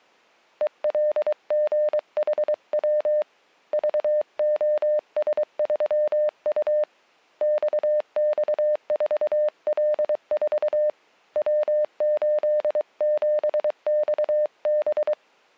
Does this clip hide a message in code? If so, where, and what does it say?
Yes: Morse code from 0.6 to 15.2 s, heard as a keyed tone, hand-sent with a paddle, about 23 wpm, 600 Hz. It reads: ELGHW VOS3U XX4L4 W87XB